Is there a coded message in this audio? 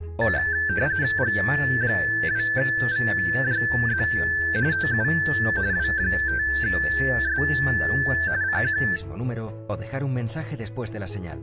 Yes: RTTY (45.45 baud, 170 Hz shift) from 0.2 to 9.0 s, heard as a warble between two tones, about 1650 Hz centre. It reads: G2VJZ TU W5S CQ